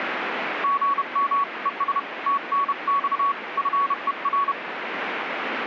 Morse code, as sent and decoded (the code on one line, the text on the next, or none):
--. -- / . ... / - -. -..- / ..-. . .-.
GM ES TNX FER